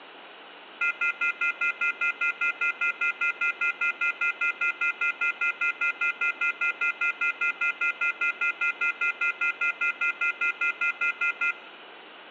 Telephone call progress tone (North American plan), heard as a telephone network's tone, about 1400, 2050, 2450, 2600 Hz, 0.1 s on and 0.1 s off. Off-hook warning tone.